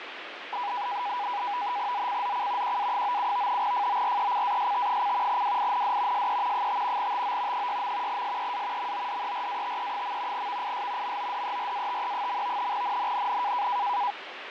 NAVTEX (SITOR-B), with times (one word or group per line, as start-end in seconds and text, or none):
1.9-2.8 ZCZC
2.6-3.6 QA97
3.6-5.4 FORECAST:
5.3-6.3 WIND
6.1-6.7 SE
6.5-7.1 5
7.0-7.7 TO
7.5-8.2 6.
8.1-8.9 SEA
8.8-10.5 MODERATE.
10.3-11.2 VIS
11.0-12.7 MODERATE.
12.7-13.7 NNNN